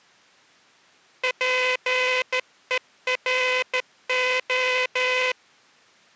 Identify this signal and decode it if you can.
Morse code, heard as a buzzer, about 14 wpm. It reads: PERO